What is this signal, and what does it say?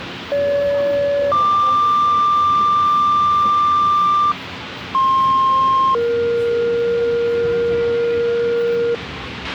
Two-tone page, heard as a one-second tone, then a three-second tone, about 570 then 1180 Hz, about 1060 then 470 Hz, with radio hiss, a squelch burst at the end and the noise of a subway station.